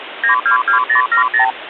Multi-frequency trunk signalling (R2, with the far end's replies), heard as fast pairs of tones, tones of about 110 ms, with phone line noise. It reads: 922070